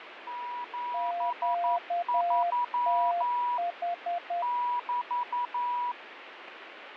Morse code, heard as two keyed tones, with radio static and fading. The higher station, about 11 wpm, 970 Hz: 73 <BT>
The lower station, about 10 wpm, 700 Hz: QTH